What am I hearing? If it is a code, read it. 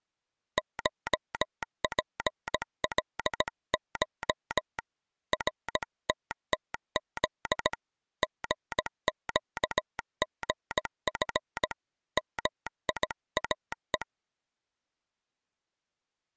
Morse code (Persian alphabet), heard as a telegraph sounder, hand-sent with a paddle, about 17 wpm. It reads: شپلش رتتز ژگژف میاه